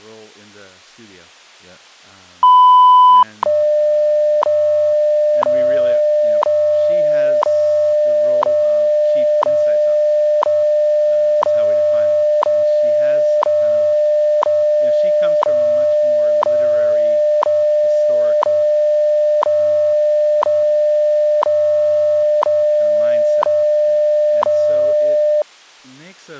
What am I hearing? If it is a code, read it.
Radio time signal (WWV, Colorado), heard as ticks, one a second, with speech in English.